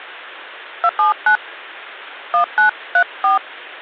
DTMF, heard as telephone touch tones, dialled by hand, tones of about 100 ms. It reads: 279 1934